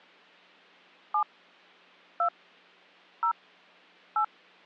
DTMF, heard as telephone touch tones, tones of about 90 ms. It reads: 7 2 0 8